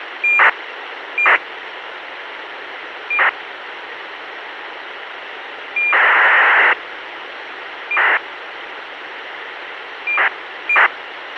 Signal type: ACARS aircraft data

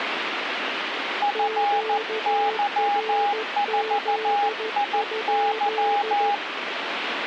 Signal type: Morse code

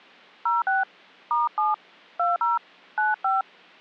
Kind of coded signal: DTMF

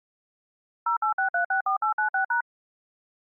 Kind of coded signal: DTMF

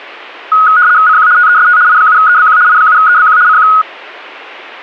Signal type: RTTY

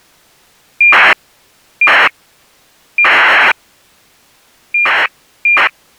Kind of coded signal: ACARS aircraft data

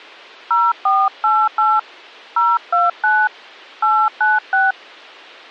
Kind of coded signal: DTMF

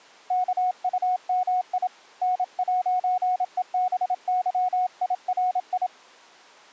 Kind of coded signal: Morse code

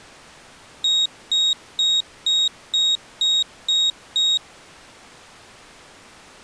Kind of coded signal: beep code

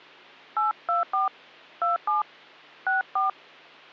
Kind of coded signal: DTMF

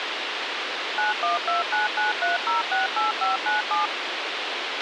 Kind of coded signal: DTMF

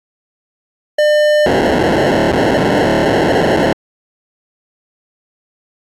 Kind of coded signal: POCSAG pager data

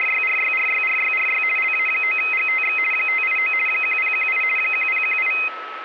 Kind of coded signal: RTTY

